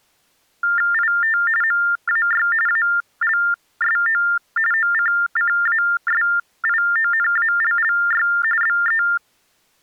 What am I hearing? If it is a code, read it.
TTY/TDD text telephone tones (45.45 baud Baudot), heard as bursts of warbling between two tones, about 400 Hz shift, 1600 Hz centre. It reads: IT MAY ALSO OCCASIONALLY BE